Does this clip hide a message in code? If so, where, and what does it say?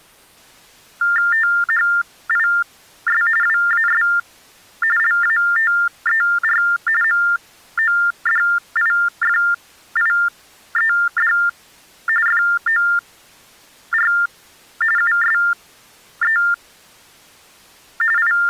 Yes: TTY/TDD text telephone tones (45.45 baud Baudot) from 1.0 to 18.5 s, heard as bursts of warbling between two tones, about 400 Hz shift, 1600 Hz centre. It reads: THIS WAS LATER MODIFIED FOR USE …